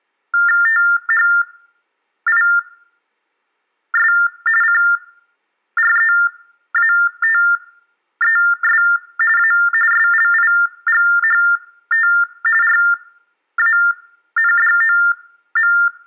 TTY/TDD text telephone tones (45.45 baud Baudot), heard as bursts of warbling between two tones, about 400 Hz shift, 1600 Hz centre, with room echo. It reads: THIS CREATES A SLIGHT RANDOM